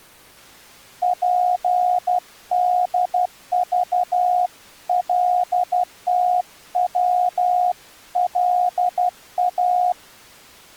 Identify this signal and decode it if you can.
Morse code (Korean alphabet), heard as a keyed tone, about 12 wpm, 720 Hz. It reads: 즐겁고